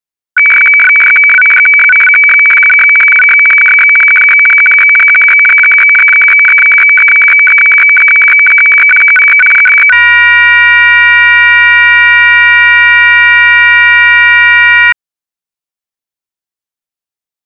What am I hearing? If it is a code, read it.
Weather fax (radiofax), 120 lines a minute, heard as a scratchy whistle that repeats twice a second.